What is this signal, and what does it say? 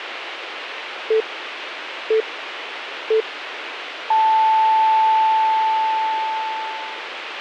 Radio time signal (three low pips and a long one an octave up, as on NHK), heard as pips, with radio hiss.